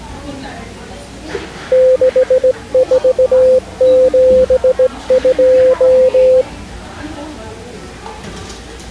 Morse code, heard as a keyed tone, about 17 wpm, 510 Hz, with the noise of a cafe. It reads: 6472